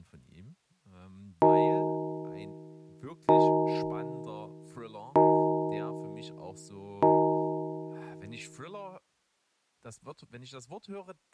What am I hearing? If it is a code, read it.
Clock strike, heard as a bell, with speech in German. 4. Four o'clock.